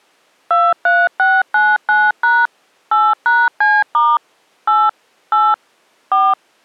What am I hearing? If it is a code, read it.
DTMF, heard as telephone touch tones, dialled by machine, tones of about 220 ms. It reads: 23699# 8#C* 8 8 4